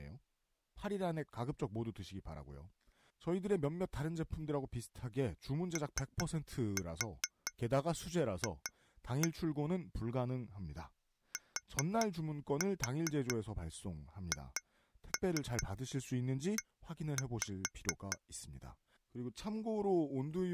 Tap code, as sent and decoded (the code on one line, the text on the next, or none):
3-4 2-1 / 4-4 2-3 1-5
OF THE